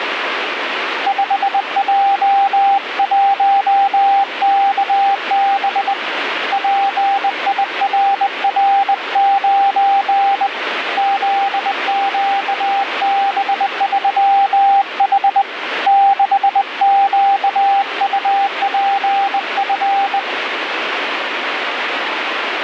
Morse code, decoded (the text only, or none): 5J1KB PIRR9 ZQB3H 6QUPF